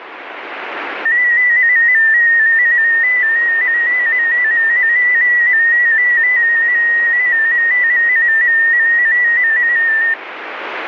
Multi-tone FSK (Olivia or MFSK type), about 250 Hz wide, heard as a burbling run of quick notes, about 15.625 baud, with radio static.